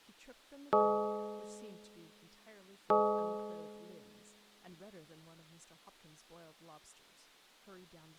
Clock strike, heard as a bell, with speech in English. 2. Two o'clock.